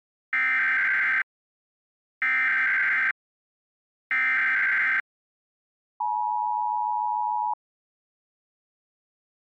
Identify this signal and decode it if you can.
Emergency Alert System (SAME) tones (header bursts, then the 853 and 960 Hz attention tone), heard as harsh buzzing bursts, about 520.83 baud.